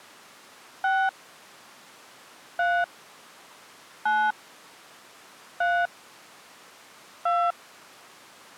DTMF, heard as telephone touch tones, dialled by hand, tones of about 250 ms. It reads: 6 3 9 3 2